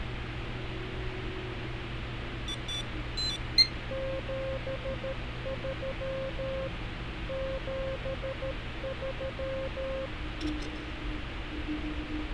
Morse code, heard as a keyed tone, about 13 wpm, 530 Hz, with radio static. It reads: 73 73